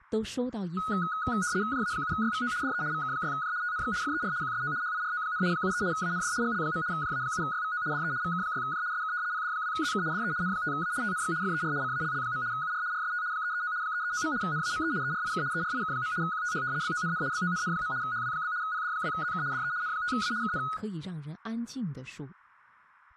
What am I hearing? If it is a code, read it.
RTTY (75 baud, 170 Hz shift), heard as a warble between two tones, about 1360 Hz centre, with speech in Chinese. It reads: JA7YVO DE VK6J TNX FER QSO HIRO, 73 AND GL. JA7YVO DE VK6J SK PD2ZK DE N5A TNX FER CALL. UR RST 339 339. NAME ERIK ERIK. QTH BONN BONN. HW? PD2ZK DE N5A KN